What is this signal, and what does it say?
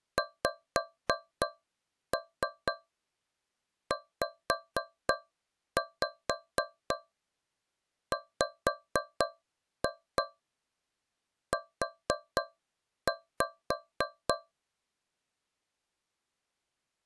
Tap code, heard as taps on a metal pipe, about 3 knocks a second. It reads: XZWU